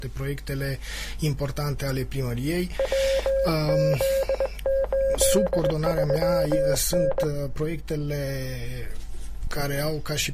Morse code, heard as a keyed tone, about 20 wpm, 540 Hz. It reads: WZ83N